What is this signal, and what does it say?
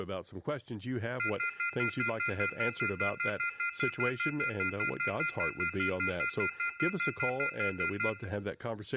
Telephone call progress tone (North American plan), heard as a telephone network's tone, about 1400, 2050, 2450, 2600 Hz, 0.1 s on and 0.1 s off, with speech in English. Off-hook warning tone.